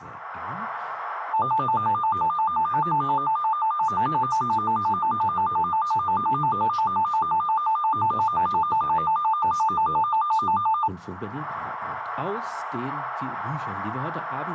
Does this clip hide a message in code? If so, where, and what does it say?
No, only a tone that alternates evenly between two pitches, with radio static and a narrow filter.